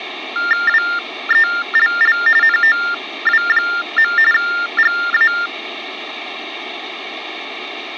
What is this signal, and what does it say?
TTY/TDD text telephone tones (45.45 baud Baudot), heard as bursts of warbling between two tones, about 400 Hz shift, 1600 Hz centre. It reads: WELL NOW. GA